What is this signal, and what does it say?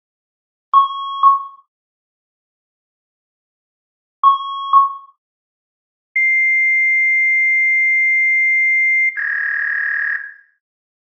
Fax machine handshake, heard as beeps, a long tone and a warble, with room echo.